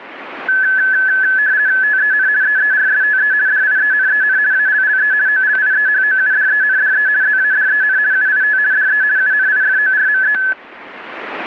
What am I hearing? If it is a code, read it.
RTTY (50 baud, 170 Hz shift), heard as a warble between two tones, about 1600 Hz centre, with static crashes. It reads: TEN EERSTE DIENEN ALLE OLIEHOUDENDE ZADEN UIT DE UNIFORME